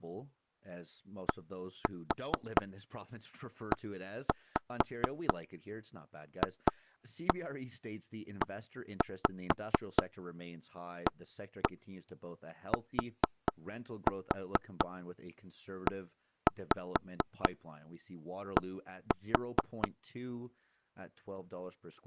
Tap code, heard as knocks on wood, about 4 knocks a second, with speech in English. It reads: DEFEATED